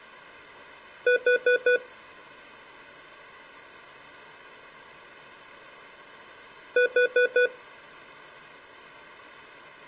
Alarm pattern, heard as an alarm's beeps, played twice, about 490 Hz. Temporal four. Carbon monoxide.